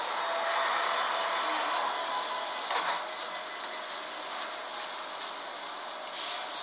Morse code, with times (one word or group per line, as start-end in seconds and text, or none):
none